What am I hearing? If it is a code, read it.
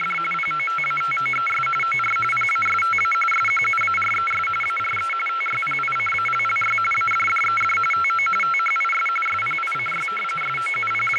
RTTY (45.45 baud, 850 Hz shift), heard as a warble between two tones, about 1750 Hz centre, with radio static and speech in English. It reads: … POTATOES OR PASTA SQUARES ARE TYPICALLY ADDED TO THIS SPICY …